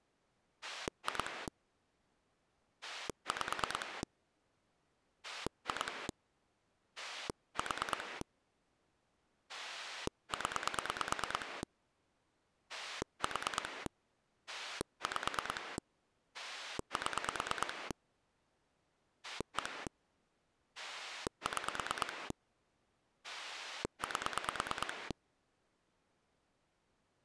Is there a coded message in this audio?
Yes: pulse dialling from 0.6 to 25.1 s, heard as a rotary dial, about 9 pulses a second. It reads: 2 5 2 4 0 4 5 7 1 6 8